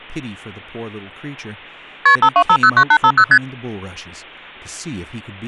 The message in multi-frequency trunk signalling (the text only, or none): KP 52509850 ST